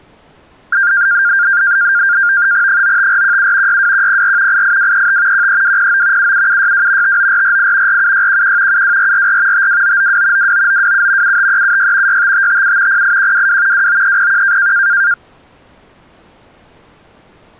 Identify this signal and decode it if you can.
NAVTEX (SITOR-B), 100 baud, 170 Hz shift, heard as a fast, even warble, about 1500 Hz centre. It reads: 95417 62104 88235 13209 77762 59448 47611 72444 52992 29927 75376 65557 08122 29301